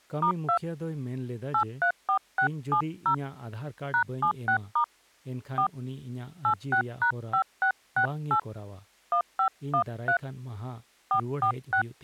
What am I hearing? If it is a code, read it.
DTMF, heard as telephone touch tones, dialled by hand, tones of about 90 ms, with speech in Santali. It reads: *2 834670 #76* 4 86#5668 1513 446